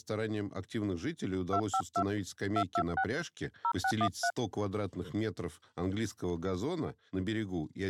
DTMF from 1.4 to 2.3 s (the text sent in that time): 252